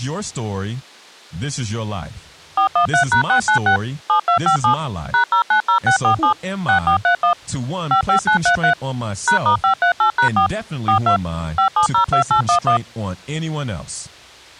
DTMF, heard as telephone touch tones, dialled by machine, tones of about 100 ms, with speech in English. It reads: 413#696 7257 #090647 6431 55933 #*538#4 42 5702811